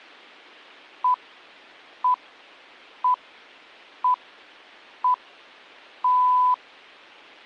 Radio time signal (six pips, as the Greenwich Time Signal), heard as pips.